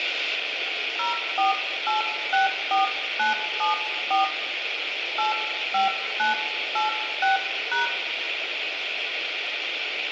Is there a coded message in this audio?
Yes: DTMF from 1.0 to 7.9 s, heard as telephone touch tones, dialled by hand, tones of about 140 ms, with radio hiss and room echo. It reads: 04864974 85986#